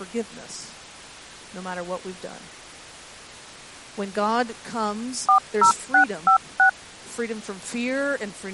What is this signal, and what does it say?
DTMF, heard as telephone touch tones, dialled by machine, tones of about 100 ms, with speech in English. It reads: 40656